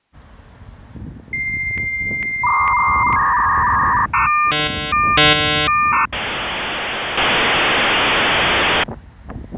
Dial-up modem handshake (V.34 or later), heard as a whistle, warbles, then hiss, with street noise.